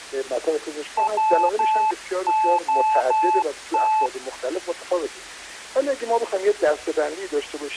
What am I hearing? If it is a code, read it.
Morse code (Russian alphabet), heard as a keyed tone, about 12 wpm, 870 Hz. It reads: ВОТ